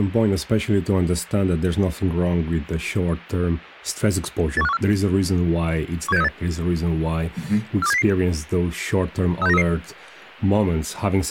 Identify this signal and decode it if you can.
Five-tone selective call (EEA), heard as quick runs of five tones, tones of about 40 ms, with speech in English. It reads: 81514 17638 42700 36933